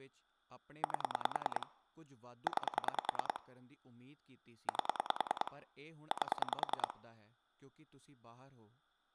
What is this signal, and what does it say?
Pulse dialling, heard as clicks on a phone line, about 10 pulses a second, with speech in Punjabi. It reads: 8 9 8 8